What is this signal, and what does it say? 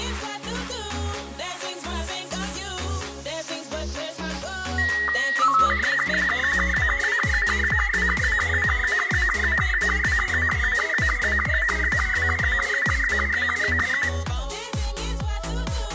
SSTV (slow-scan television), Robot 72, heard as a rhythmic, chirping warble, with room echo.